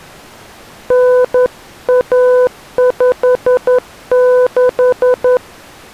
Morse code (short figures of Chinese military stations), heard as a keyed tone, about 11 wpm, 500 Hz. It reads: 9156